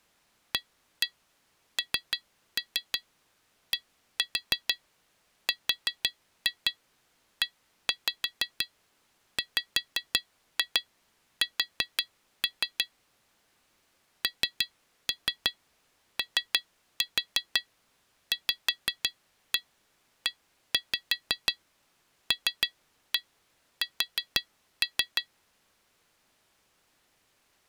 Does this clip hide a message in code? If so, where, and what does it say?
Yes: tap code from 0.5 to 25.3 s, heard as taps on glass, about 6 knocks a second. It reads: ANDREWS NOVELS